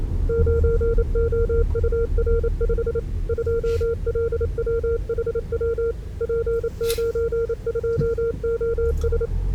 Morse code, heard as a keyed tone, machine-sent, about 28 wpm, 460 Hz, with the noise inside a car. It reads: 9OUR5 2LWHW P92OS